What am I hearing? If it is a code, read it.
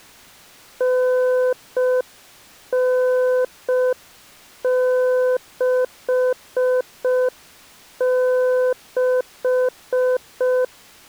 Morse code (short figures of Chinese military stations), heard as a keyed tone, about 5 wpm, 510 Hz. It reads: 9966